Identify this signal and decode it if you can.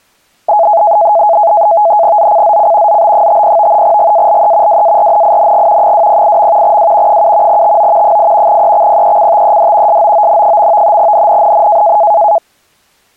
NAVTEX (SITOR-B), 100 baud, 170 Hz shift, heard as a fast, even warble, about 750 Hz centre. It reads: ZCZC ZB50 GALE WARNING 208. W 7 TO 8 EXPECTED SOON. NNNN